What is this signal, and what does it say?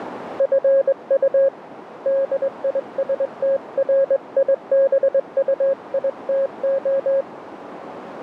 Morse code, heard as a keyed tone, hand-sent with a straight key, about 21 wpm, 540 Hz, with radio static and a narrow filter. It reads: FU DISTRIBUITO